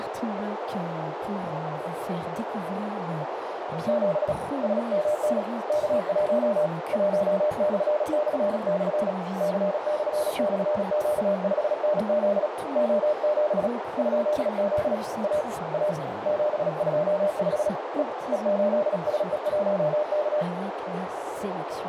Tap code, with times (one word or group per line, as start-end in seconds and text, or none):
none